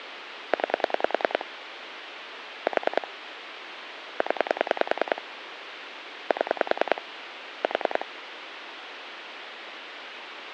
Pulse dialling, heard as clicks on a phone line, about 10 pulses a second, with phone line noise. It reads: 9 4 0 7 4